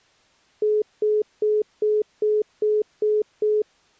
Telephone call progress tone (single-tone plan, as in most of Europe), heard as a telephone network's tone, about 420 Hz, 0.2 s on and 0.2 s off. Congestion tone.